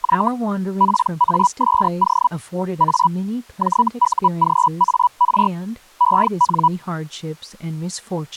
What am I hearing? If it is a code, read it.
Hellschreiber (Feld-Hell, 122.5 baud), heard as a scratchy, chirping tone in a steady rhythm, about 980 Hz, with speech in English. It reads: Y PASO A JUGAR EN